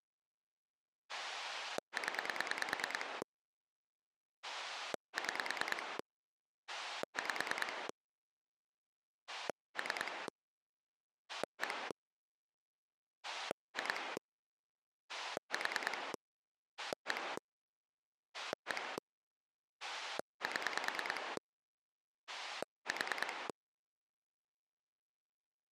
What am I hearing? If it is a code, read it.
Pulse dialling, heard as a rotary dial, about 9 pulses a second. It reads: 0 6 5 3 1 2 4 1 1 7 4